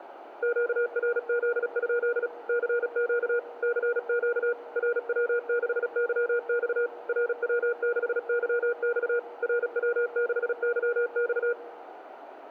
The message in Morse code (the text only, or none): QRZ? CQ CQ RW6YX RW6YX RW6YX